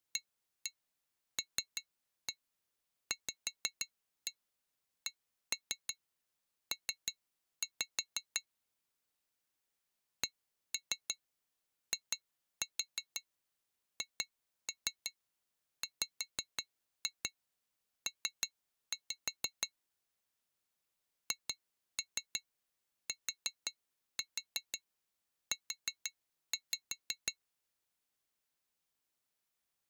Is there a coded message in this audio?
Yes: tap code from 0.2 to 27.4 s, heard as taps on glass, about 5 knocks a second. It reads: ALVCP CIHWP HTU